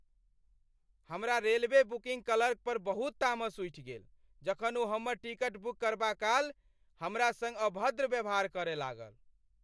Speech in Maithili. There is no code.